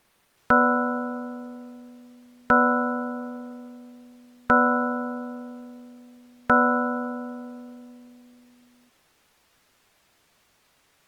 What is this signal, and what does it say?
Clock strike, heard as a bell. 4. Four o'clock.